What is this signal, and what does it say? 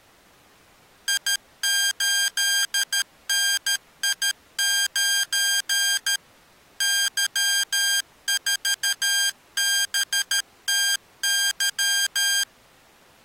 Morse code, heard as electronic beeps, machine-sent, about 13 wpm, 1600 Hz. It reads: I8NI9 Y4BTY